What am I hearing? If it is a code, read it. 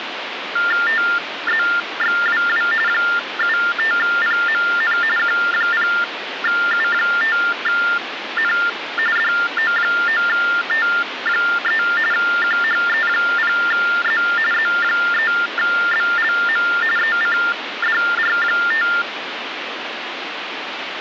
TTY/TDD text telephone tones (45.45 baud Baudot), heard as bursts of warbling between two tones, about 400 Hz shift, 1600 Hz centre, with phone line noise. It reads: TZXWW 75PMN Q0U5N DO9T3 QHE0Z Z3BLM ECDR5